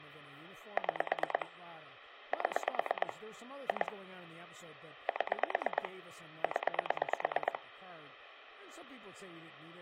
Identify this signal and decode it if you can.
Pulse dialling, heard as clicks on a phone line, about 9 pulses a second, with phone line noise and speech in English. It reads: 6 7 2 7 0